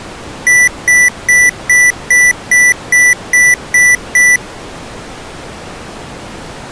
Beep code, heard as beeps from a small speaker, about 1950 Hz. 10 short. In AMI BIOS tables: CMOS shutdown register error.